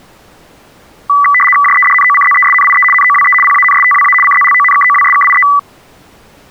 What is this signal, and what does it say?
RTTY (75 baud, 850 Hz shift), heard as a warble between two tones, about 1550 Hz centre. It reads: JEDNOCZESNIE NOWE PANSTWA CZLONKOWSKIE